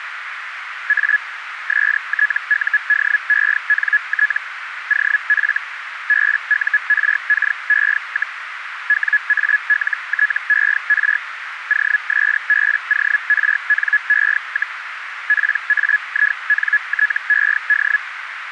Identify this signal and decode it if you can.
Hellschreiber (Feld-Hell, 122.5 baud), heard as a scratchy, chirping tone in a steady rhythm, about 1700 Hz, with radio static and a narrow filter. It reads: A STUDENT OF BURKE, WALTER OSBORNE, PAINTED